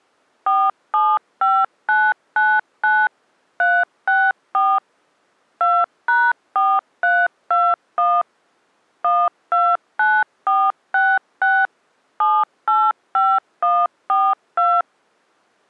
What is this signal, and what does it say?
DTMF, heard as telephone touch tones, dialled by machine, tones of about 230 ms. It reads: 475999 364 2#4321 129466 785142